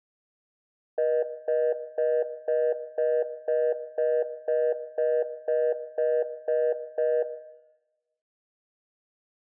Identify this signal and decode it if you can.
Telephone call progress tone (North American plan), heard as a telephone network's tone, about 480, 620 Hz, 0.25 s on and 0.25 s off, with room echo. Congestion tone.